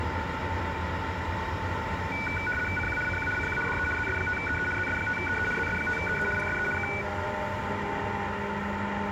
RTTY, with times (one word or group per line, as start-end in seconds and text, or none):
2.8-3.0 CQ
3.1-3.3 CQ
3.4-3.6 CQ
3.7-3.9 DE
4.0-4.7 ZS5EE
4.8-5.5 ZS5EE
5.6-6.3 ZS5EE
6.4-6.7 PSE
6.8-6.9 K